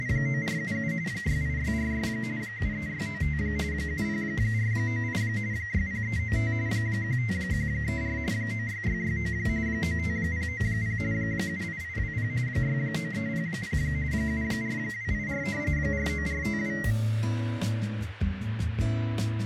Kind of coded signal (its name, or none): RTTY